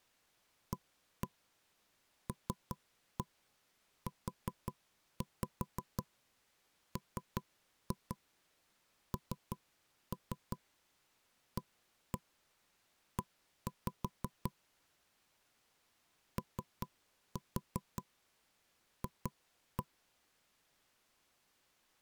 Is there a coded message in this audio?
Yes: tap code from 0.7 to 19.9 s, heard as knocks on wood, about 5 knocks a second. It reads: ALUMNAE OF